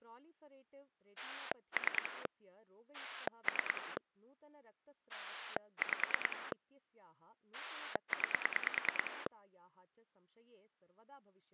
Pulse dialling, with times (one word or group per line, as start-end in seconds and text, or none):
1.2-2.3 3
2.9-4.0 3
5.1-6.5 5
7.5-9.3 9